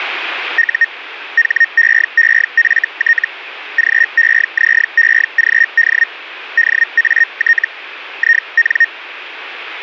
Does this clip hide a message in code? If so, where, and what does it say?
Yes: Hellschreiber (Feld-Hell, 122.5 baud) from 0.6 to 8.9 s, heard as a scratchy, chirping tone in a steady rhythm, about 1850 Hz, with radio static. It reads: U HEEFT GEZEGD DAT IN